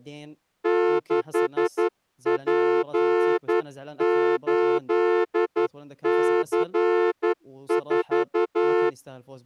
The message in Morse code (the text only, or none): 6P8C4